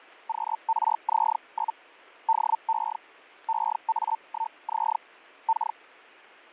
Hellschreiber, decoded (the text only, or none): QRZ? DE EA1Z K